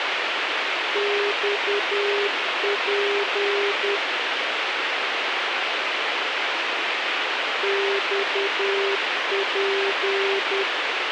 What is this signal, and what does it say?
Morse code, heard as a keyed tone, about 10 wpm, 400 Hz, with radio hiss and a squelch burst at the end. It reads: XP XP